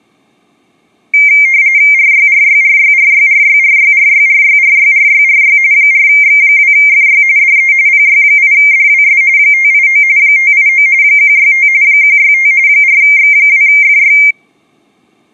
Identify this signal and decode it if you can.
RTTY (45.45 baud, 170 Hz shift), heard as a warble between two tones, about 2200 Hz centre. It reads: RYRYRYRYRYRYRYRYRYRYRY 4X2FY DE PY8DWS 589 589 165 165 4X2FY